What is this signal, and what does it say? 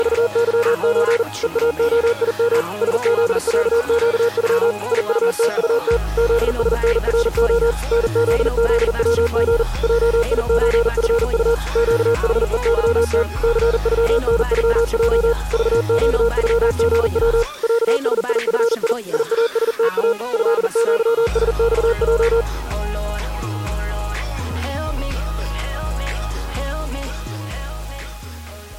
Morse code (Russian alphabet), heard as a keyed tone, machine-sent, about 40 wpm, 470 Hz. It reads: … ЕАОИМ СЗЯЩЮ ИУТУТ ЗСНРО НЗЗВГ ЙИЧФУ ЩХЕЫТ ЦЮНЮЙ ЖЩЮГВ ЯСИФИ ИАСТА ЭЪСЬЙ